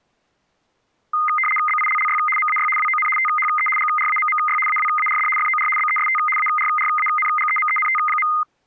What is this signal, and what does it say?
RTTY (75 baud, 850 Hz shift), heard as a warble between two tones, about 1650 Hz centre. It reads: BILLY MAY WON THE GRAMMY AWARD FOR BEST ARRANGEMENT.